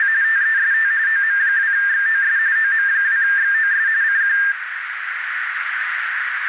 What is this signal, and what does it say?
RTTY (45.45 baud, 170 Hz shift), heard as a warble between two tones, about 1700 Hz centre, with radio static and a narrow filter. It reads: … TEST OM2XOS OM2XOS CQ